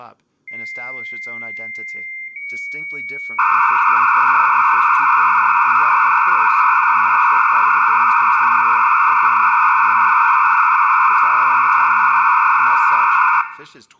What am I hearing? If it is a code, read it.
Dial-up modem handshake (low-speed, two carriers), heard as two whistles, then hiss, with room echo and speech in English.